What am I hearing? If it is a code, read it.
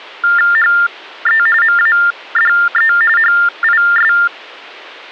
TTY/TDD text telephone tones (45.45 baud Baudot), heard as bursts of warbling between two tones, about 400 Hz shift, 1600 Hz centre. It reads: HE MADE HIS